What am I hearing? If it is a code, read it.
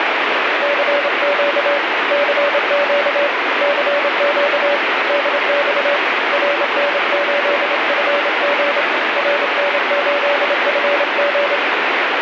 Morse code, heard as a keyed tone, hand-sent with a straight key, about 27 wpm, 570 Hz, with heavy radio static. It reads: CQ CQ CQ DX RN8FG RN8FG